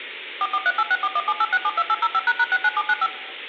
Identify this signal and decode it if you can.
DTMF, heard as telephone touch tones, dialled by machine, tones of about 50 ms. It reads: 443864178672805##69795